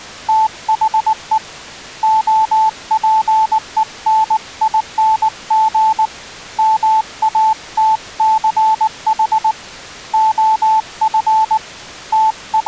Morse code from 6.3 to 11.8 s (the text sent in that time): MATCH OF